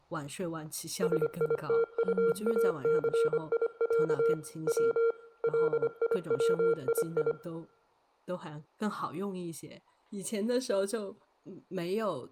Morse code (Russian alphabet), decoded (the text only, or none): СИТУАЦИЯ В ЛИВИИ